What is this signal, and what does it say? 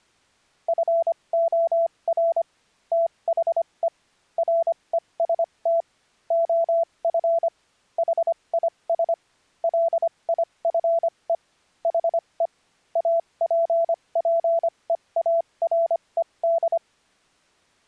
Morse code, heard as a keyed tone, machine-sent, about 25 wpm, spaced as for 21 wpm, 670 Hz. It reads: FOR THE REST OF HIS LIFE HE APPEARED